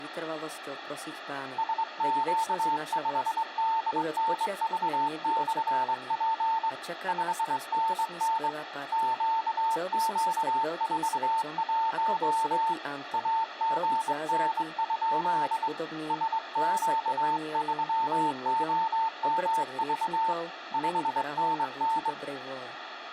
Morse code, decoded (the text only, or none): SQ5DNV/P 5NN QQ41 AGN? SQ3OMV 5NN